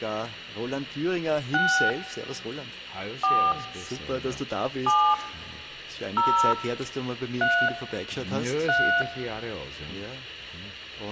DTMF, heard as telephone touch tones, dialled by hand, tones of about 290 ms. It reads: 6 4 7 0 3 3